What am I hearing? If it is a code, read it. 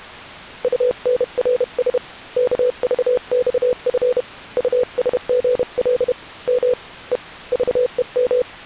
Morse code, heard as a keyed tone, hand-sent with a paddle, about 31 wpm, 500 Hz. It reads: UNRS KVXF USGL M E VEM